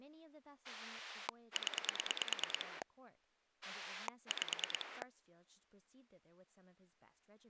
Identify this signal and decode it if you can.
Pulse dialling, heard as a rotary dial, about 9 pulses a second, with speech in English. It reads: 0 5